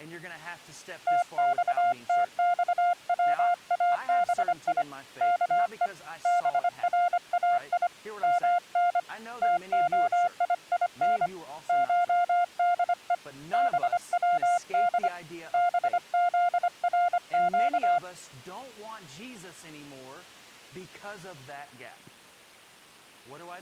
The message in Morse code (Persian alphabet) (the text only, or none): تختخوابی که برای من تعیین شده بود بزرگ